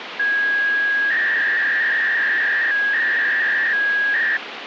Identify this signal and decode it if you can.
300-baud modem data (V.21 tones), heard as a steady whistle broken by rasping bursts, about 300 baud, 200 Hz shift, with phone line noise.